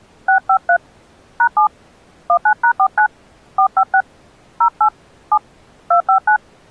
DTMF, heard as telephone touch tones, dialled by hand, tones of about 80 ms. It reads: 653 #7 19#49 456 08 7 259